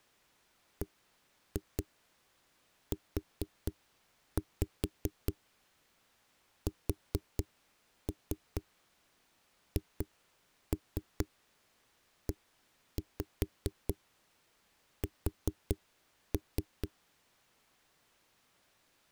Tap code, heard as knocks on a wall, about 4 knocks a second. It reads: BUSHES